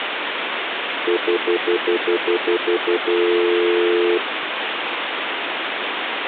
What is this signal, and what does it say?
Telephone call progress tone (North American plan), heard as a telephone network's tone, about 350, 440 Hz, 0.1 s on and 0.1 s off, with phone line noise. Stutter dial tone.